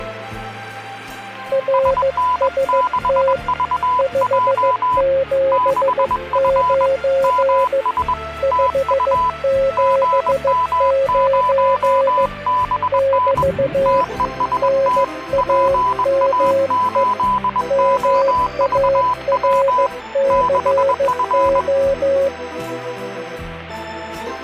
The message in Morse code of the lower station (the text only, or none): RST 579 579 <BT> NAME MARCO